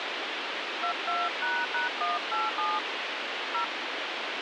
DTMF, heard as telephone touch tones, dialled by hand, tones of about 170 ms, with radio hiss. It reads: 22##187 0